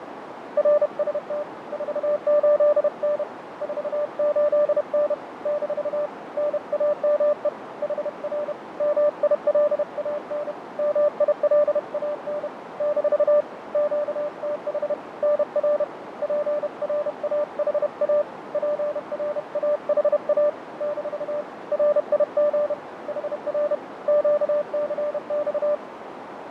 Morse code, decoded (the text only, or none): RST 48N 48N - NAME HR MILAN MILAN - QTH NR PRAHA PRAHA - RIG HR QCX